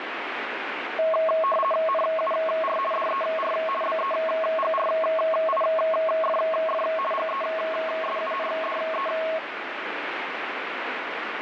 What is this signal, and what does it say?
RTTY (50 baud, 450 Hz shift), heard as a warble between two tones, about 870 Hz centre, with radio static. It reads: NUR DER BEGRIFF GESUNDE